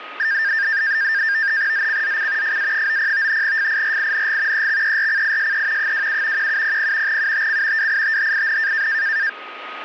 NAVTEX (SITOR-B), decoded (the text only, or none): ZCZC FA90 FIRING EXERCISE 27 1700 UTC WITHIN